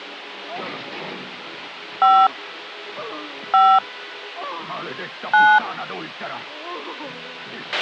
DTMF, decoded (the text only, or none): 5 5 9